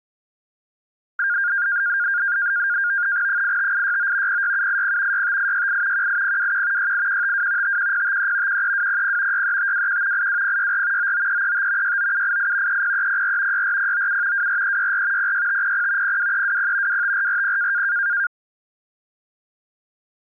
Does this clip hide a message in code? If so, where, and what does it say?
Yes: NAVTEX (SITOR-B), 100 baud, 170 Hz shift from 1.2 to 18.3 s, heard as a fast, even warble, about 1500 Hz centre. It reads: 85869 06780 65868 18021 68152 51053 13200 63521 82064 99335 69788 30304 64097 24364 06500 02320 25440